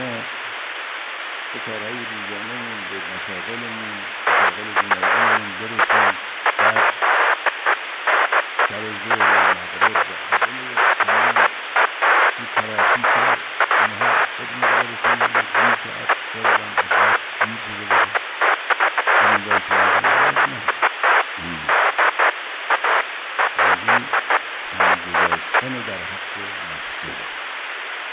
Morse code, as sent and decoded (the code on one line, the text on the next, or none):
none